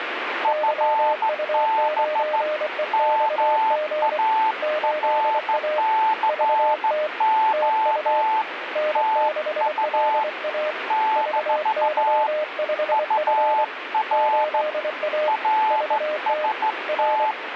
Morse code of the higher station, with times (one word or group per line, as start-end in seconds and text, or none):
0.4-2.4 FB
2.9-8.4 MARCO
9.0-10.2 TU
10.9-12.3 -
12.9-14.6 UR
15.3-17.3 RST